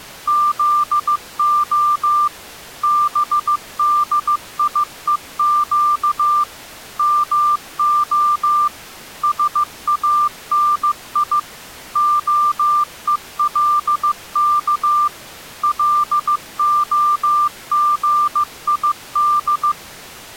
Morse code (Hebrew alphabet), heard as a keyed tone, machine-sent, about 15 wpm, 1190 Hz. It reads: זה בדיוק מה שאני הולך להגיד